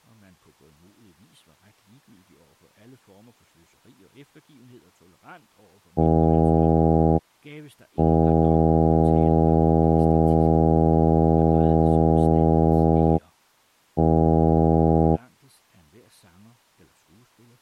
Ship horn signal, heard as a ship's horn, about 80 Hz, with speech in Danish. 1 short, 1 long, 1 short. At sea: a vessel at anchor warns of its position.